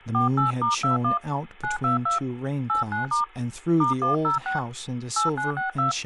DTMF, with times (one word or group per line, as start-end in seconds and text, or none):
0.1-1.2 48*21
1.6-2.2 922
2.7-3.2 89*
3.8-4.6 *106
5.2-5.9 8962